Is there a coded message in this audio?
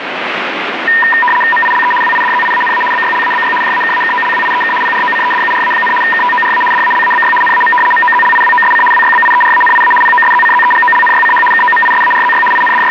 Yes: RTTY (75 baud, 850 Hz shift) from 0.9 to 12.9 s, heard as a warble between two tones, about 1410 Hz centre, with radio static. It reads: MILE WIDZIANA BYLABY JAKAKOLWIEK PROCEDURA, KTORA DALABY NAM MOZLIWOSC WYBIERANIA POSZCZEGOLNYCH KOMISARZY …